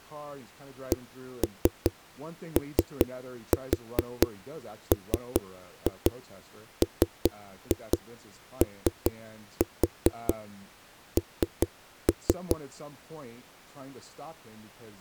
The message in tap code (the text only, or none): COMMON